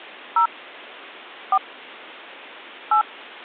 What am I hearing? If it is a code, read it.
DTMF, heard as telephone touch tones, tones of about 80 ms. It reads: 0 4 8